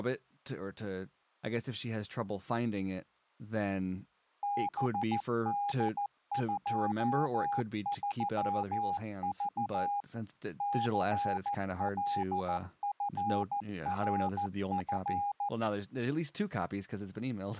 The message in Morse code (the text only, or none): BD23V CLFRF